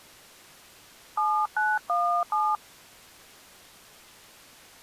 DTMF, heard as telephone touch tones, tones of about 230 ms. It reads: 7917